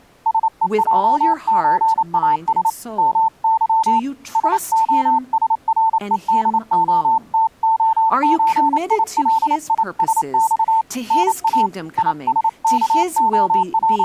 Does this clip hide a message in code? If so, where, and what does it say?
Yes: Morse code (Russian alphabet) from 0.2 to 14.0 s, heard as a keyed tone, hand-sent with a paddle, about 28 wpm, 890 Hz, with speech in English. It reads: СЕЙЧАС МЫ СОСРЕДОТОЧИЛИСЬ НА …